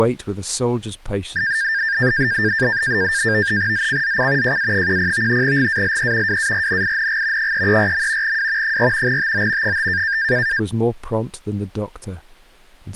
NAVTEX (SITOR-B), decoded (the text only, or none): ZCZC JA10 GALE WARNING 334. W 4 TO 5